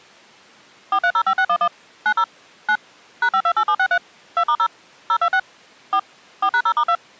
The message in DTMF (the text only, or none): 4305611 90 9 #528763 2*0 026 4 4#0*2